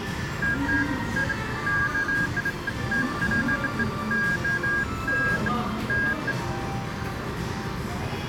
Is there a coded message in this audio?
No, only beeps of irregular length, with the noise of a cafe.